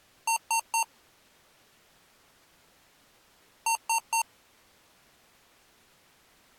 Beep code, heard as beeps from a small speaker, played twice, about 910 Hz. 3 short. In AMI BIOS tables: failure in the first 64 KB of memory; in Dell tables: chipset error.